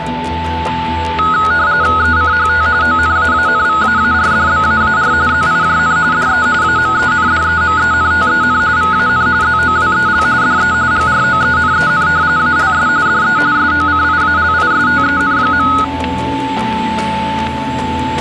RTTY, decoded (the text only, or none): ECHT ONAANVAARDBAAR ZIJN DE AMENDEMENTEN VAN ZOWEL DE GROENEN ALS DE SOCIALISTEN.